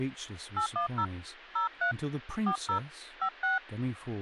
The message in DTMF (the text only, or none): 810 03 40 56